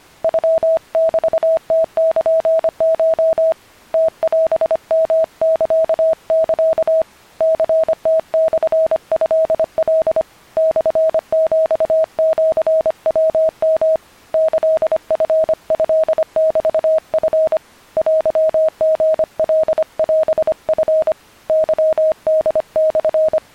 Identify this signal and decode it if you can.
Morse code (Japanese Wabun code), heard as a keyed tone, hand-sent with a paddle, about 25 wpm, 640 Hz. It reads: ノメムルコ ムオヨササ ニムモトカ モヒシヤヨ キチトメチ テリカオチ …